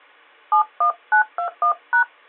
DTMF, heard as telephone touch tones, dialled by hand, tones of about 100 ms. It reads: 71921#